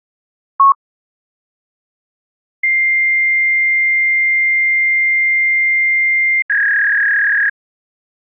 Fax machine handshake, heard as a long tone and a warble.